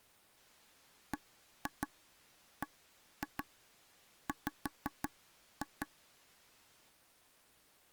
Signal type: tap code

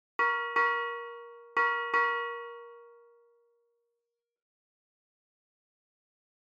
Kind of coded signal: ship's bell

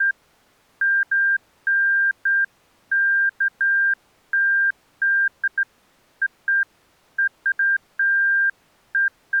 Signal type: none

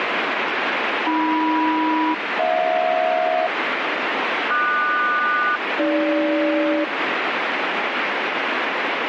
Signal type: aircraft SELCAL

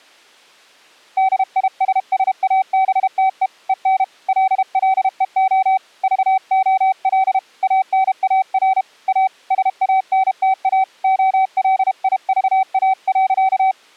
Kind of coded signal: Morse code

